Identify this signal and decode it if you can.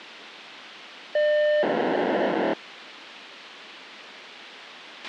POCSAG pager data (1200 baud), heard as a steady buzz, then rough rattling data, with radio hiss and a squelch burst at the end.